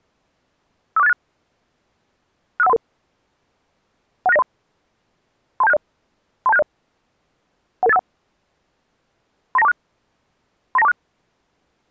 Five-tone selective call (EIA), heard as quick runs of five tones, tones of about 30 ms. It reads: 54686 65133 16903 32760 32760 11851 39246 39246